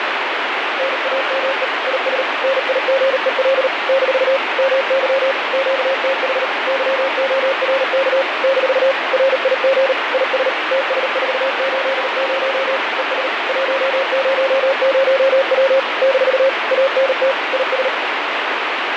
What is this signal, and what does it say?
Morse code, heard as a keyed tone, machine-sent, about 38 wpm, 540 Hz, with heavy radio static and fading. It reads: NAME IS NIGEL - MY QTH YORK - RIG IS TS480 ES 100W - ANT IS